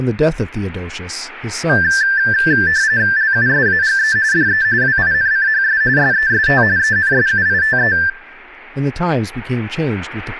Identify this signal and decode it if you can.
RTTY (45.45 baud, 170 Hz shift), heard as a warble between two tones, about 1650 Hz centre, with speech in English. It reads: LUSAGE DE WINCHS SEST ENSUITE